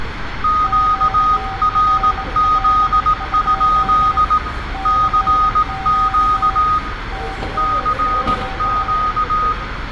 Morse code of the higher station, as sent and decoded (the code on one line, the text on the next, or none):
--.- .-. --.. ..--.. / -.-. --.- / -.-. --.-
QRZ? CQ CQ